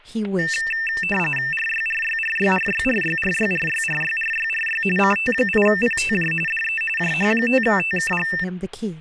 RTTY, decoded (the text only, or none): RYRYRYRYRYRYRYRYRYRY CT8PTJ DE JH5TKG